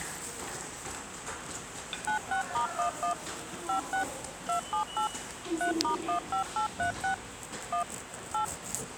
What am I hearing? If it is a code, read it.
DTMF, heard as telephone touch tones, dialled by machine, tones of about 110 ms, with the noise of a subway station. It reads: 96*11 56 278 3*15836 1 8